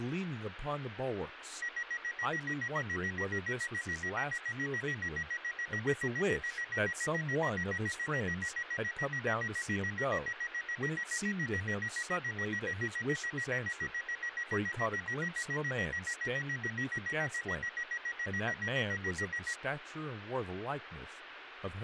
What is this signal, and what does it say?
Evenly repeated beeps, with speech in English. There is no code.